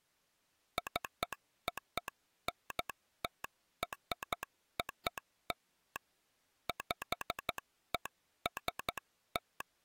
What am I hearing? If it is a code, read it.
Morse code (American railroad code), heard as a telegraph sounder, hand-sent with a straight key. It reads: CONTROL PEST